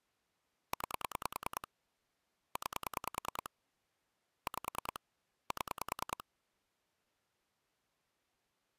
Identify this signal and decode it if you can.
Pulse dialling, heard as clicks on a phone line, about 10 pulses a second. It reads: 9 9 5 7